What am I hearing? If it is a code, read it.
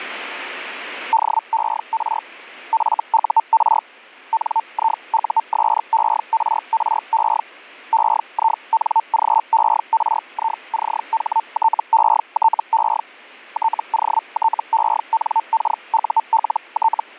Hellschreiber (Feld-Hell, 122.5 baud), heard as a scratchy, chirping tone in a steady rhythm, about 900 Hz. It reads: DER FUR NIUSERRE EINGERICHTETE TOTENKULT